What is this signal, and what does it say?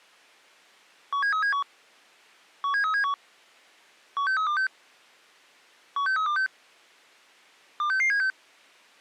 Five-tone selective call (CCIR), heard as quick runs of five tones, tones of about 100 ms. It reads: 17371 17371 16326 16326 26676